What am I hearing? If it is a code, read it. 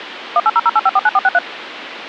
DTMF, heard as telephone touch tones, dialled by machine, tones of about 40 ms, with phone line noise. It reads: 18008549463